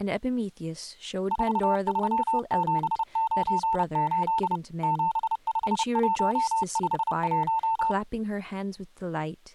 Morse code, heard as a keyed tone, machine-sent, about 30 wpm, 900 Hz, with speech in English. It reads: 43798 75151